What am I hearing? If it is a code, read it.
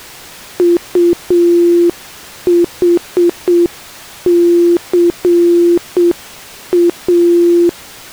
Morse code, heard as a keyed tone, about 7 wpm, 340 Hz. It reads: UHCA